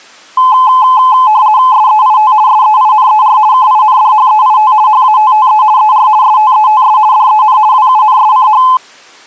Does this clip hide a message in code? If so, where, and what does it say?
Yes: RTTY (50 baud, 170 Hz shift) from 0.4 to 8.8 s, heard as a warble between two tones, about 940 Hz centre. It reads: SEIT SEINER KINDHEIT HATTE ER STETS DEN WUNSCH